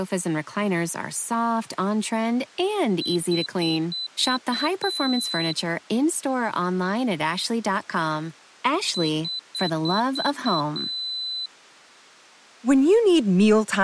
Beep code, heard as a piezo beeper, played twice, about 4000 Hz, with speech in English. 6 short, 1 long.